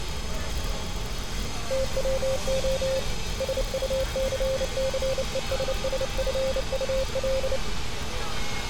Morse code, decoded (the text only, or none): TWO SUCCESSFUL